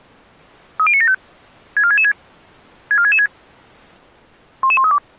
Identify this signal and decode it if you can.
Five-tone selective call (ZVEI), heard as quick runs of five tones, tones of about 70 ms. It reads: 30975 64666 64666 11132